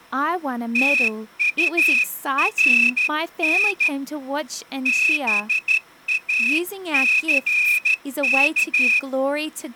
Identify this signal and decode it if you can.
Morse code, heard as a whistle, hand-sent with a straight key, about 13 wpm, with speech in English. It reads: TURN BACK